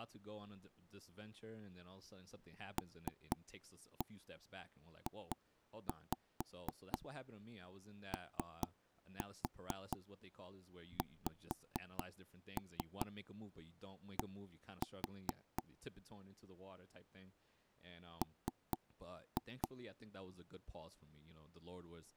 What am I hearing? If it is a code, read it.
Tap code, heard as knocks on wood, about 4 knocks a second, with speech in English. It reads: LJOXD M